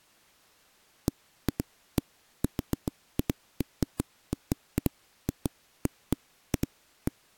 Irregular knocks on a wall. There is no code.